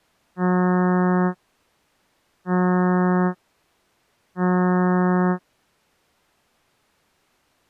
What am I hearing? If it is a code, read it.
Ship horn signal, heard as a ship's horn, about 180 Hz. 3 short. At sea: I am operating astern propulsion.